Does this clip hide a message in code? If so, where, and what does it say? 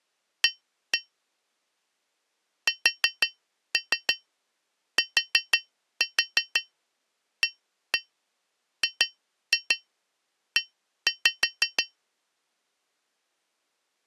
Yes: tap code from 0.4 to 12.0 s, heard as taps on glass, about 6 knocks a second. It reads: A STAGE